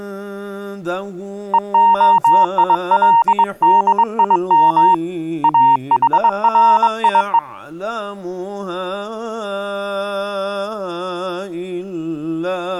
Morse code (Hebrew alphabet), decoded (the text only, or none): והילדים אחריו